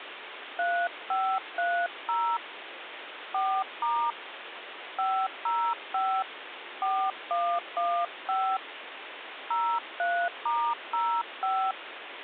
DTMF, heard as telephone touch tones, dialled by hand, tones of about 280 ms, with phone line noise. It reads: 3530 4* 505 4115 03*05